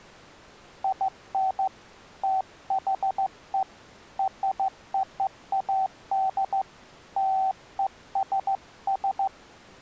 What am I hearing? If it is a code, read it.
Morse code (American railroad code), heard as a keyed tone, hand-sent with a straight key, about 760 Hz. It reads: IN THE ROAD LESS